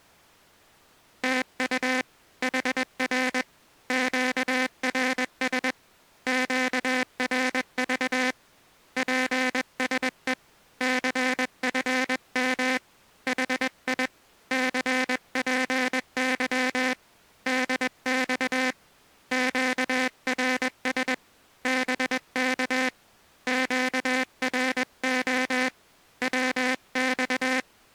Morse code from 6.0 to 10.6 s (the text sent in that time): QRV PSE